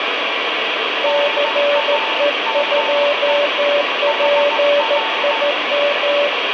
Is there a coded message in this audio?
Yes: Morse code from 1.0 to 6.3 s, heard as two keyed tones, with heavy radio static. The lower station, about 14 wpm, 580 Hz: CE2PIM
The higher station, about 15 wpm, 890 Hz: NAME HR